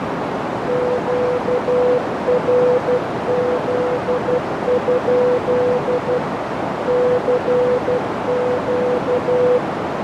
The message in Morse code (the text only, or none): QRZ? CQ